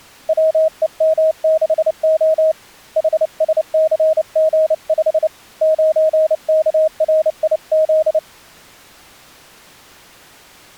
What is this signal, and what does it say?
Morse code, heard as a keyed tone, hand-sent with a paddle, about 29 wpm, 630 Hz. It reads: WEM6O HSCG5 9KRIZ